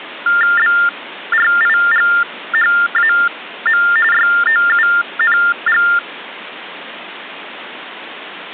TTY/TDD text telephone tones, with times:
0.6-3.8 BRIGHAM
4.1-5.8 YOUNG

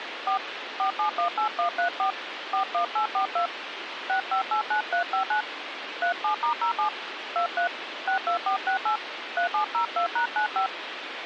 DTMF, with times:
0.3-0.4 4
0.8-2.1 4718134
2.5-3.5 41842
4.1-5.4 6589359
6.0-6.9 37*07
7.4-7.7 23
8.1-9.0 62468
9.4-10.7 3702#95

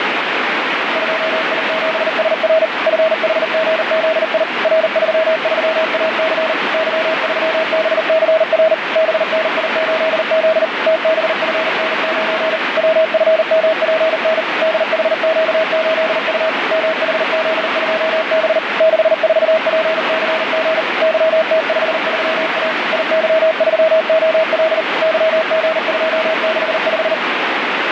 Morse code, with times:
1.0-2.6 2I7SR
2.9-4.4 FHGZI
4.6-6.5 R33AC
6.7-8.7 Y3BCR
9.0-10.6 BNI8Z
10.9-12.6 TBFN9
12.8-14.4 WFMPN
14.6-16.5 DHQ8U
16.7-18.6 MHZ2B
18.8-20.8 64PCG
21.0-22.7 YT53A
22.9-24.8 IY3OL
25.0-27.1 YG265

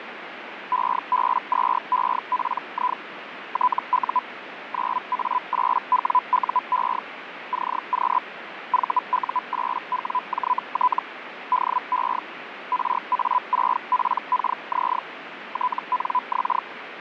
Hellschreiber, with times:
0.7-3.0 EB2EPI
3.5-4.2 TU
4.7-7.0 9A8WUE
7.5-8.2 CQ
8.7-11.0 VU8WJT
11.5-12.2 DE
12.7-15.0 RA6PKZ
15.5-16.6 TNX

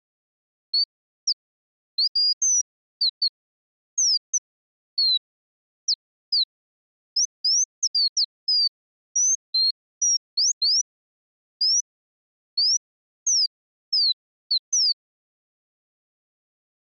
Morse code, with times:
none

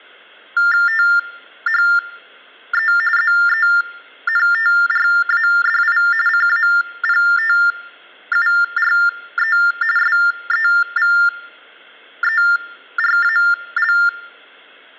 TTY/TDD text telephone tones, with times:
0.9-2.9 THE
3.2-6.0 ZENTRADI
6.3-9.6 CAPTURE
10.0-13.9 SEVERAL

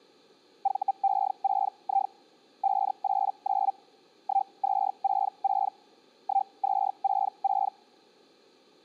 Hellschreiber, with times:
0.6-2.1 VE6I
2.6-3.7 589
4.2-5.7 1266
6.2-7.7 1266

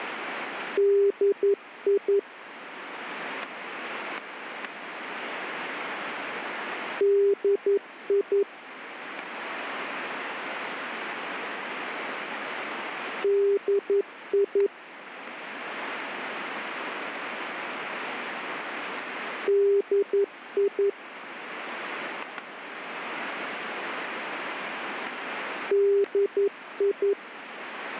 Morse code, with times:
0.8-2.2 DI
7.0-8.4 DI
13.2-14.7 DI
19.5-20.9 DI
25.7-27.1 DI

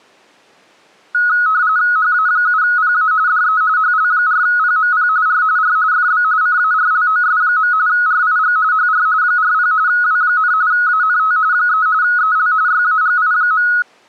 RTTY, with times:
2.0-3.1 HA7PA
3.3-3.6 DE
3.8-5.1 HL4PMP
5.3-5.4 R
5.6-5.8 R
5.9-6.2 FB
6.4-7.7 CARLOS.
7.9-8.6 RIG
8.7-9.1 HR
9.2-9.7 40
9.9-10.5 W,
10.7-11.4 ANT
11.5-11.9 3
12.0-12.5 EL
12.7-13.7 YAGI.

